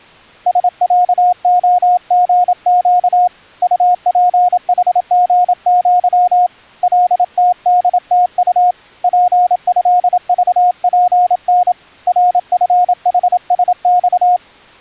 Morse code (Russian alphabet), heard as a keyed tone, hand-sent with a paddle, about 27 wpm, 720 Hz. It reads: СЯОГЩ УПХГЪ ЛТДТУ ПЭЖПН РФХСЬ